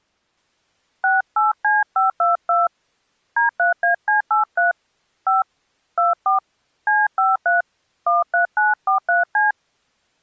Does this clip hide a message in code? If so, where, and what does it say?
Yes: DTMF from 1.0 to 9.5 s, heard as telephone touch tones, dialled by hand, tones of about 160 ms. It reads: 68C522 D3AC83 5 24 C53 13943C